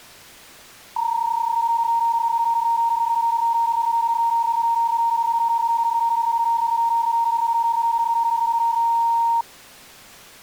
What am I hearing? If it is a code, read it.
PSK31 (31.25 baud), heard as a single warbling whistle, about 930 Hz.